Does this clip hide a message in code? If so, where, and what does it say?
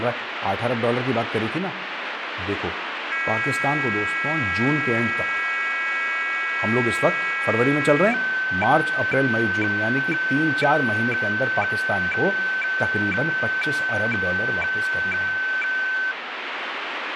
Yes: weather fax (radiofax), 120 lines a minute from 3.1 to 16.1 s, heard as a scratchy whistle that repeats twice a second, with radio static and speech in Urdu.